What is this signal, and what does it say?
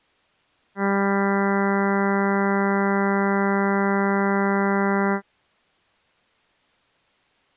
Ship horn signal, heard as a ship's horn, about 200 Hz. 1 long. At sea: a vessel nearing a blind bend, or under power and making way in fog.